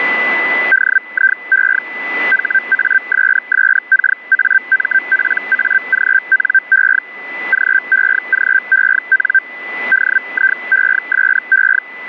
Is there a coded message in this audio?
Yes: Hellschreiber (Feld-Hell, 122.5 baud) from 0.7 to 11.8 s, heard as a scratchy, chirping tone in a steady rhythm, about 1550 Hz, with a steady whistle near 2000 Hz. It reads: DIE HASSKAMPAGNE GEGEN DIESE